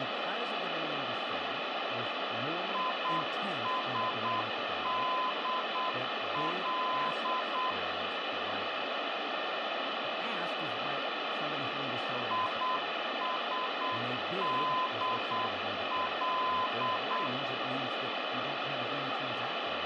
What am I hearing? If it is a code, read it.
Morse code, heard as a keyed tone, machine-sent, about 8 wpm, 1020 Hz, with radio static, room echo and speech in English. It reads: ISDL ISDL